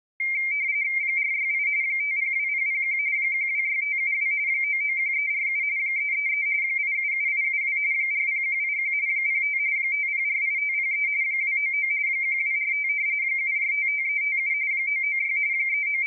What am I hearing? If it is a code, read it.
RTTY (45.45 baud, 170 Hz shift), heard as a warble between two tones, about 2200 Hz centre. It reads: 468 502001 126572 991347 333 877872 40181 05 5048503 299 1245 7455357 996 …